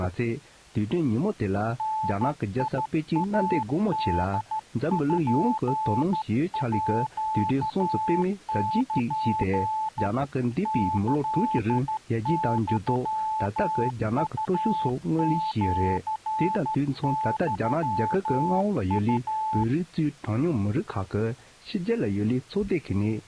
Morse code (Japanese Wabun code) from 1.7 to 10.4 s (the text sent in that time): ダイポール